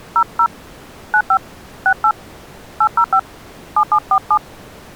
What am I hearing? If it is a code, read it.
DTMF, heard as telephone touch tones, dialled by hand, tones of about 70 ms. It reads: 00 95 68 805 7747